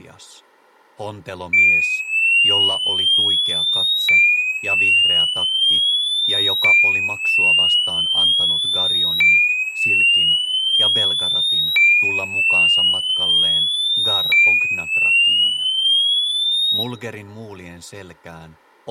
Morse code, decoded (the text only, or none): none